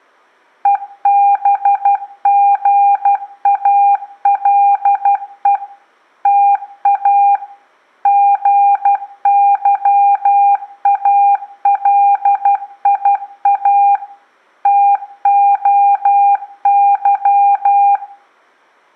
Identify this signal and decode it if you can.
Morse code (Greek alphabet), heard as a keyed tone, machine-sent, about 12 wpm, 800 Hz, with room echo. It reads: ΕΒΓΑΛΕ ΤΑ ΓΥΑΛΙΑ ΤΟΥ